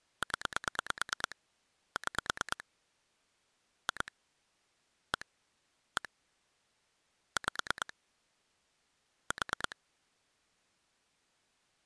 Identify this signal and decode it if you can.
Pulse dialling, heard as clicks on a phone line, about 9 pulses a second. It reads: 0 6 2 1 1 5 4